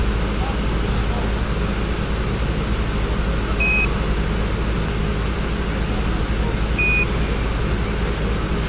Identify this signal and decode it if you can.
Quindar tones, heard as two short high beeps, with a squelch burst at the end and street noise.